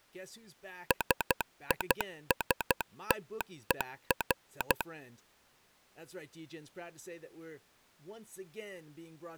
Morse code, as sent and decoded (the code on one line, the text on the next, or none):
... .. ... - . .-.
SISTER